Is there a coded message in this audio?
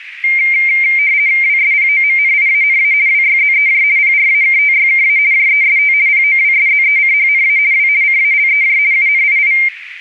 Yes: RTTY (50 baud, 170 Hz shift) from 0.2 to 9.7 s, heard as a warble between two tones, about 2200 Hz centre, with radio static and a narrow filter. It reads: WSPOMNIANA WYZEJ PRAKTYKA JEST POWSZECHNA W CALEJ UNII